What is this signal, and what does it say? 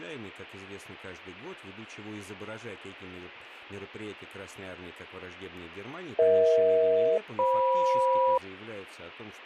Aircraft SELCAL, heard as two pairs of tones, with speech in Russian. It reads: EH-FM